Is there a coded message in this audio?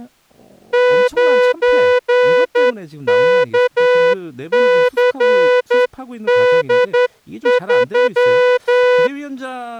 Yes: Morse code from 0.7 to 9.1 s, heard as a horn, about 10 wpm, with speech in Korean. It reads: 9KCD3